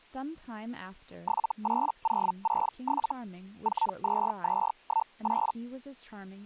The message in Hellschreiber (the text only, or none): 78067 42218